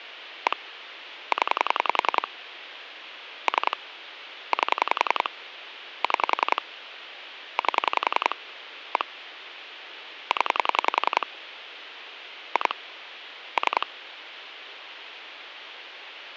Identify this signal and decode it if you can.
Pulse dialling, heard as clicks on a phone line, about 10 pulses a second, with phone line noise. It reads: 1 0 3 8 6 8 1 0 2 3